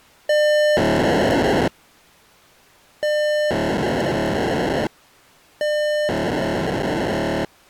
POCSAG pager data (1200 baud), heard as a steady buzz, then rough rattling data.